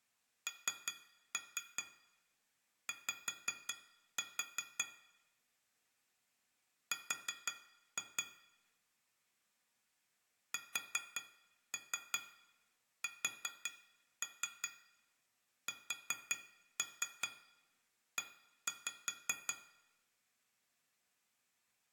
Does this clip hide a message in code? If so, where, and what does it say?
Yes: tap code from 0.5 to 19.6 s, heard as taps on glass, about 5 knocks a second, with room echo. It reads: NY R SSSE